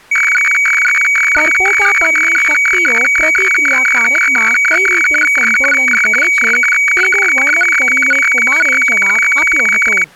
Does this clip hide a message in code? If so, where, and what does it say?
Yes: weather fax (radiofax), 120 lines a minute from 0.1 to 10.0 s, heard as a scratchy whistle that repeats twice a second, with speech in Gujarati.